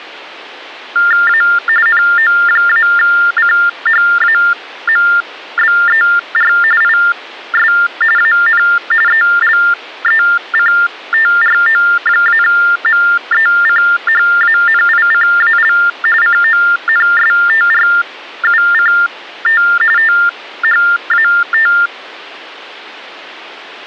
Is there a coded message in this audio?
Yes: TTY/TDD text telephone tones (45.45 baud Baudot) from 1.0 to 21.9 s, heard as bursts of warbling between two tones, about 400 Hz shift, 1600 Hz centre. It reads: A NO-CHAMBER IS AN ELECTRO-MECHANICAL CONSTRUCT THAT